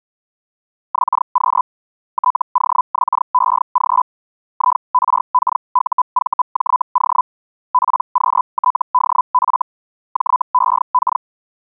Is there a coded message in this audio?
Yes: Hellschreiber (Feld-Hell, 122.5 baud) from 0.9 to 11.2 s, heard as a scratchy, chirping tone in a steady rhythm, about 1000 Hz. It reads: XQ TOXEG IRKUVJO PQTDF JEK